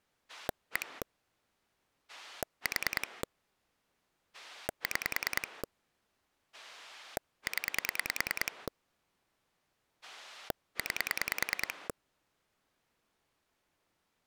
Pulse dialling, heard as a rotary dial, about 10 pulses a second. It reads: 1 4 6 0 9